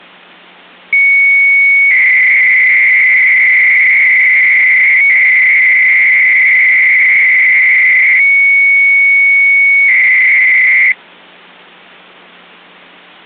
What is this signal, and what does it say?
300-baud modem data (Bell 103 tones), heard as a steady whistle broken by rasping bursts, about 300 baud, 200 Hz shift.